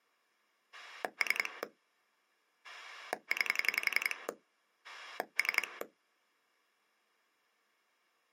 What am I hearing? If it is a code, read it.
Pulse dialling, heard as a rotary dial, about 11 pulses a second. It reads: 3 9 3